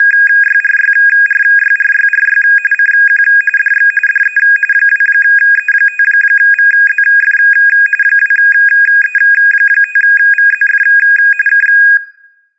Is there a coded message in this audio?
Yes: RTTY (45.45 baud, 850 Hz shift) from 0.0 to 12.0 s, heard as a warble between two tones, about 2050 Hz centre. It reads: … CQ DX DE 2E5VZF 2E5VZF K